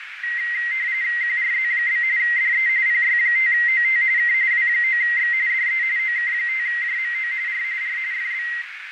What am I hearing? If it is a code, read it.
RTTY (45.45 baud, 170 Hz shift), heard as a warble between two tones, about 2000 Hz centre, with radio static, fading and a narrow filter. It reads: QRZ? DE PY5OT K W9X DE OK5JMO R R FB